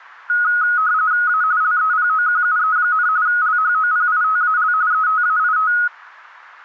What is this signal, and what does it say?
RTTY (45.45 baud, 170 Hz shift), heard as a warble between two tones, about 1360 Hz centre. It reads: A LEPOQUE, LHOPITAL ETAIT